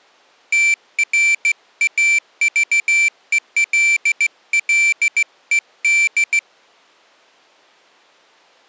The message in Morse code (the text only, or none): TRAVELLED